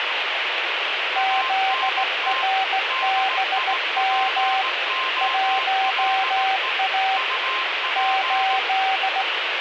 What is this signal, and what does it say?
Morse code, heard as two keyed tones, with radio static. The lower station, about 16 wpm, 770 Hz: ZRBM 1A 8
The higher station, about 18 wpm, 1050 Hz: ANT DIPOLE UP